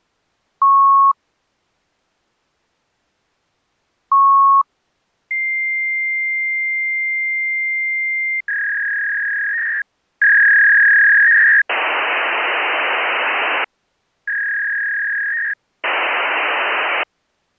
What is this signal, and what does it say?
Fax machine handshake, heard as beeps, a long tone, a warble and hiss.